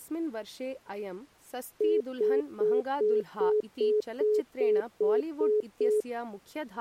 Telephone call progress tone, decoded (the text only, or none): congestion tone